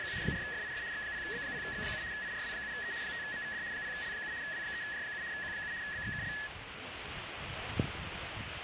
RTTY (75 baud, 170 Hz shift), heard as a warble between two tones, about 1800 Hz centre, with radio static and the noise of a residential street. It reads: … 4FIF X0B0X7 IRW7E 5MVD 0L7 W3J7 Q7 BXKL